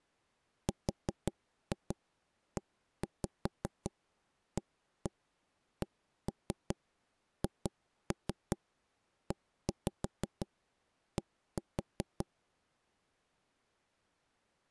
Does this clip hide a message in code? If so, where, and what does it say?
Yes: tap code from 0.7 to 12.2 s, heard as knocks on wood, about 5 knocks a second. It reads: REACHED